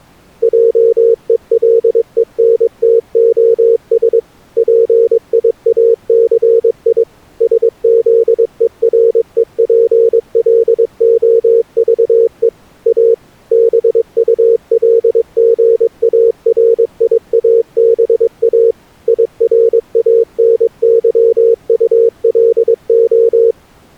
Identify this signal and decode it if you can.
Morse code, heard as a keyed tone, machine-sent, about 22 wpm, 460 Hz. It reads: JELENTOS PIACI SZEREPLOVE A BULGARIABA IRANYULO